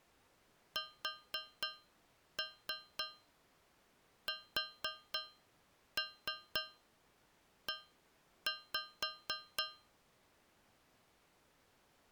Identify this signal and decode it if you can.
Tap code, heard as taps on a metal pipe, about 4 knocks a second. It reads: SSE